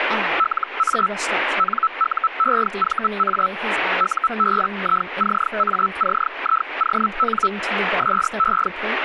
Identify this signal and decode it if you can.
Hellschreiber (Feld-Hell, 122.5 baud), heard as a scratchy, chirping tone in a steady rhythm, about 1320 Hz, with radio static and speech in English. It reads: LA NUEVA UBICACION SE